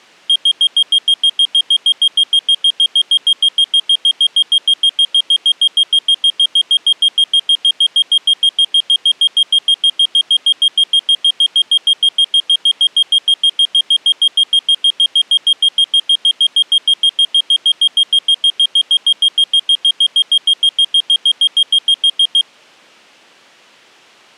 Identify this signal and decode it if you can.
Evenly repeated beeps. There is no code.